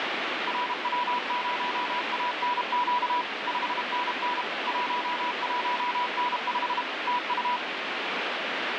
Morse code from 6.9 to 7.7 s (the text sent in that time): TU